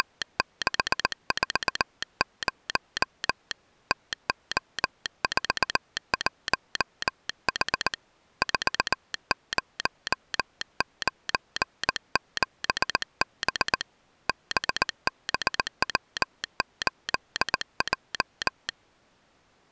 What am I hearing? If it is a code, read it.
Morse code, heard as a telegraph sounder, hand-sent with a paddle, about 19 wpm. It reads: … TO41H 4097B BBW8J